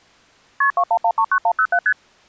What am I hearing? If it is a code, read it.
Multi-frequency trunk signalling (R1, as on North American trunks), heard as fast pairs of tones, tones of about 70 ms. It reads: KP 21139107 ST